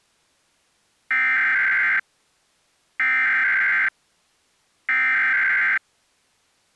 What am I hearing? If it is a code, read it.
Emergency Alert System (SAME) tones (header bursts), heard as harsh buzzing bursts, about 520.83 baud.